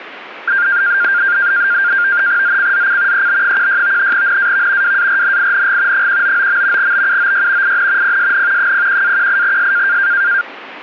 NAVTEX (SITOR-B), 100 baud, 170 Hz shift, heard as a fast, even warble, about 1500 Hz centre, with static crashes. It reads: ZCZC EB16 NAV WARNING 199. BUOY IN PSN 01-18S